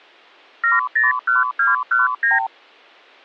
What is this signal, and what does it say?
Multi-frequency trunk signalling (R2, with the far end's replies), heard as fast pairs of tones, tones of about 160 ms. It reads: 701219